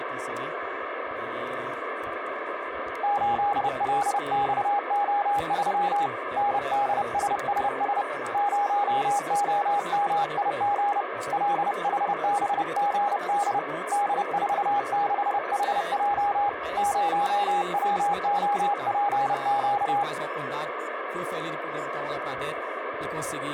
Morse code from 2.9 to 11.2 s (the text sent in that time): 8LXO3 NDSSS 0OMIG